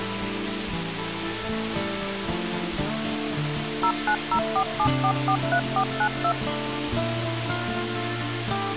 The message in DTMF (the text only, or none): 09047443492